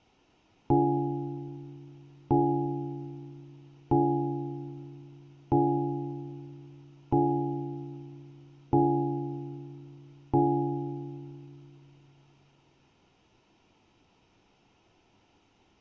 Clock strike, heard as a bell, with room echo. 7. Seven o'clock.